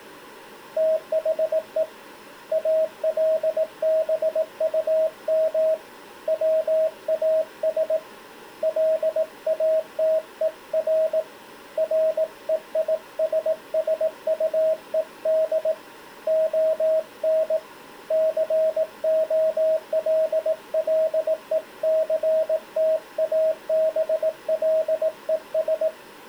Morse code, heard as a keyed tone, hand-sent with a paddle, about 18 wpm, 640 Hz. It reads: THE ALBUM WAS LATER REISSUED ON COLLECTABLES